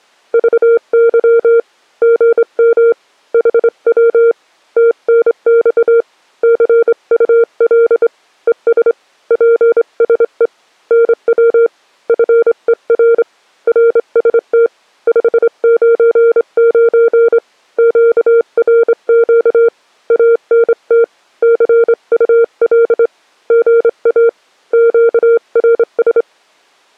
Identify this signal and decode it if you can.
Morse code, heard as a keyed tone, hand-sent with a straight key, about 25 wpm, 460 Hz. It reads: VY GM HW TNX CUL ES PSE NW FER RST 599 QRQ ANT CUL GA QRS